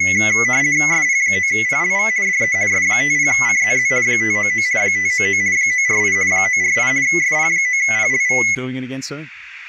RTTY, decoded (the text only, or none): SP9PLV DE S50CZZ 599 599 948 948 SP9PLV